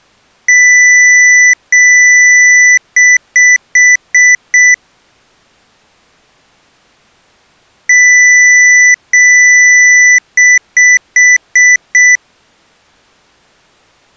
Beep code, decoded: 2 long, 5 short

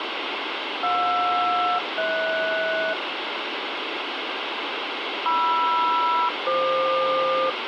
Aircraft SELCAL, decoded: JR-HS MR-FQ

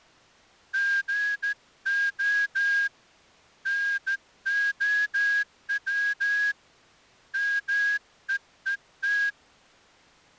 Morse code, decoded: GO NOW MEET

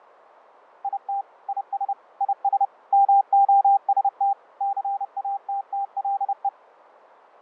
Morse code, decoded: IT IS IS MOST CATTLE

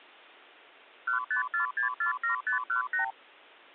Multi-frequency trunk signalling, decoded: 154647518

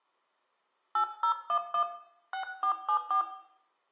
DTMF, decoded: 8011 6474

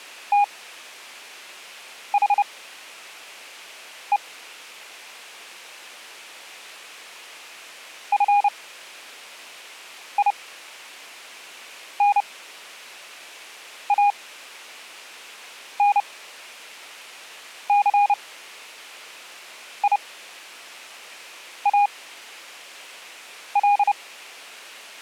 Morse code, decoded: THE FINANCIAL

